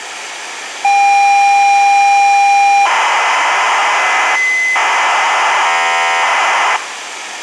ZX Spectrum tape loading, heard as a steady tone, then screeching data, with tape hiss and room echo.